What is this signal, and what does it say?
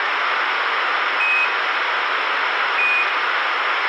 Quindar tones, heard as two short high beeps, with radio hiss, a squelch burst at the end and room echo.